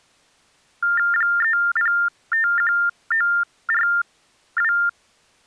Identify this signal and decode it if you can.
TTY/TDD text telephone tones (45.45 baud Baudot), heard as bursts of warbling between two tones, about 400 Hz shift, 1600 Hz centre. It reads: 3051942